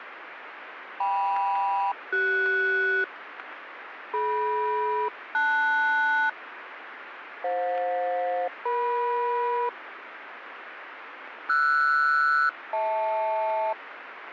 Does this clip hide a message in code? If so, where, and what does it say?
Yes: aircraft SELCAL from 1.0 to 13.7 s, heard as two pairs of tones, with radio static. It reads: KM-CS DM-LS FJ-EM RS-HL